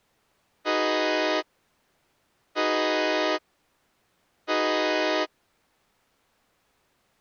Train horn signal, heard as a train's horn. 3 short. On North American railways: when stopped, the train will back up.